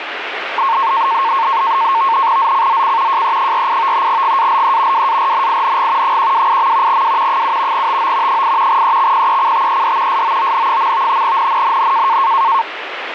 NAVTEX (SITOR-B), 100 baud, 170 Hz shift, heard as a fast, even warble, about 1000 Hz centre, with radio static. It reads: ZCZC JE48 GALE WARNING 128. W 7 TO 8 EXPECTED SOON. NNNN